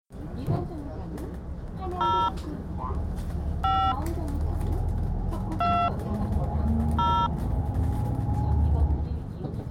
DTMF, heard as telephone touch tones, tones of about 280 ms, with the noise inside a bus. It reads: 0 5 2 0